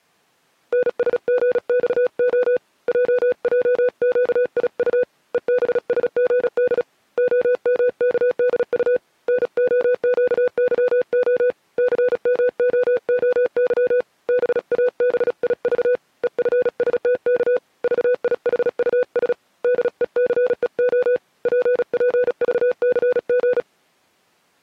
Morse code, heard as a keyed tone, hand-sent with a paddle, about 36 wpm, 500 Hz. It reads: NSGXO JJQIU EBSGD OMKDU NOQYO CMOOY BABIV EFSTK VIHUS DECEO PPVCG